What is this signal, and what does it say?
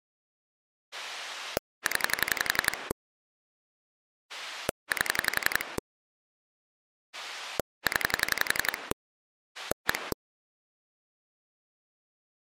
Pulse dialling, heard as a rotary dial, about 11 pulses a second. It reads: 0 8 0 1